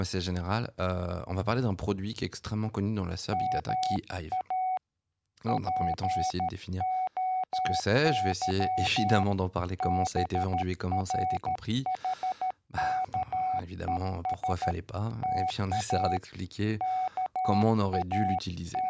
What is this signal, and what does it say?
Morse code (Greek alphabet), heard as a keyed tone, hand-sent with a paddle, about 13 wpm, 750 Hz, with speech in French. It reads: ΜΑ ΠΟΥ ΒΡΗΚΕΣ ΤΑ …